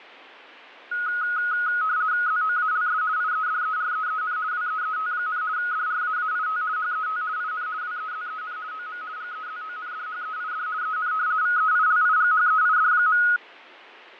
RTTY (50 baud, 170 Hz shift), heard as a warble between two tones, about 1360 Hz centre, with radio static and fading. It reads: ZOALS IEDEREEN WEET, DRAAIT HET IN WEZEN OM GEZONDHEID EN VEILIGHEID.